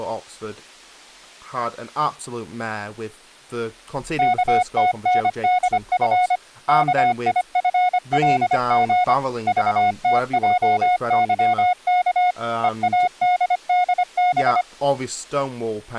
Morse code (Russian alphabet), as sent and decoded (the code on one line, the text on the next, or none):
-.- - -. -.. ..-. / -.- .. ..-. .-.. --. / ...- - .--- -.-- -.- / . .- -.. -.. -...
КТНДФ КИФЛГ ЖТЙЫК ЕАДДБ